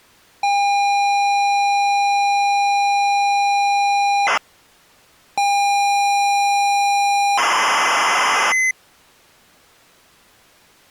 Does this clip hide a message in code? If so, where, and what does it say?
Yes: ZX Spectrum tape loading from 0.4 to 8.7 s, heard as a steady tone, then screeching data.